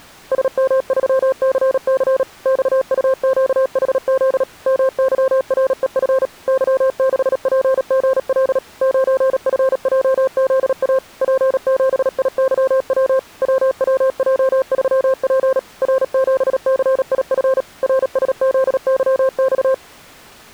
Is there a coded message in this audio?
Yes: Morse code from 0.3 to 19.8 s, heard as a keyed tone, machine-sent, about 37 wpm, 530 Hz. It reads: SM3CC XUQHZ MYREF Y6PGL 9FJZA P7IYW WWJ3P R7CIF RSZYX